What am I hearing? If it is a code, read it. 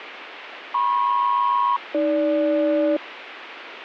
Aircraft SELCAL, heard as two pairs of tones, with radio static. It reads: MP-AG